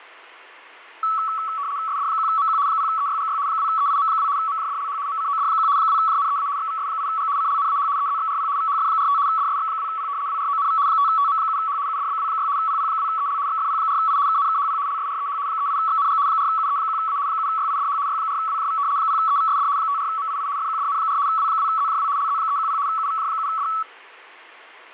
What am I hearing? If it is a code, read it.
RTTY (75 baud, 170 Hz shift), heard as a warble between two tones, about 1220 Hz centre, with fading. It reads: SD1MQ 0EYGY 2EIM2 MJDLH MCOD1 2JNEA XVS8G CLNAH EZXRP VHF45 DSX2P WRONV 5TM7H UDBW6 PP2EL XFP4I KNKHP LSREH 38XNG 4UE1A 7YIDH Y4WJV 0EVSD 54MII FQDN4 W2ZJW LZ310 UVJ7D